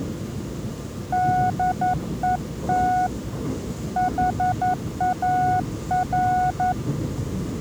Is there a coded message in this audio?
Yes: Morse code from 1.1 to 6.8 s, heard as a keyed tone, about 11 wpm, 730 Hz, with the noise inside a subway train. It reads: DET HAR